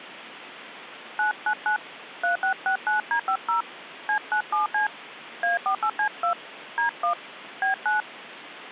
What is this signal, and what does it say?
DTMF, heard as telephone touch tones, dialled by hand, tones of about 110 ms, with phone line noise. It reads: 999 3669D50 C97C A48C2 D1 B9